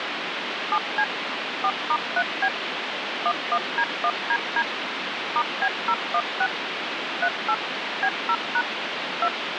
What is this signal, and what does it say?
DTMF, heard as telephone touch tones, dialled by machine, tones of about 60 ms, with phone line noise. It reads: 7C 4*3B 11D1DD *B016 38 B0# 2